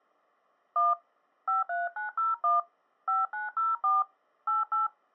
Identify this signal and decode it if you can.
DTMF, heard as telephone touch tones, dialled by hand, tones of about 160 ms. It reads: 1 53901 5904 88